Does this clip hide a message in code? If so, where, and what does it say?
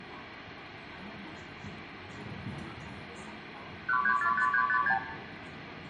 Yes: multi-frequency trunk signalling (R2, with the far end's replies) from 3.9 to 5.0 s, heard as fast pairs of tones, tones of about 80 ms, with phone line noise, room echo and the noise inside a bus. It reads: 1345356